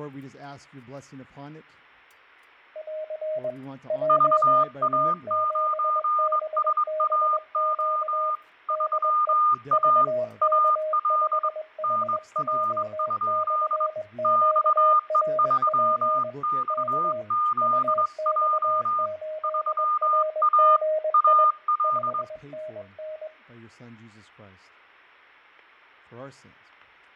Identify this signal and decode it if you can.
Morse code, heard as two keyed tones, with fading and room echo. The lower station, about 21 wpm, 620 Hz: <AR> JA7BBQ DE VK5HJ/QRP K UX8RGI 5NN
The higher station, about 22 wpm, 1220 Hz: VA9SAO 3A AL NR? XE3XZJ 3A AL